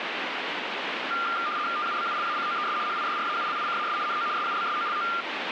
RTTY (75 baud, 170 Hz shift), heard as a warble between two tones, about 1290 Hz centre, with radio static. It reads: TUBULACOES HIDRAULICAS NO SUBSOLO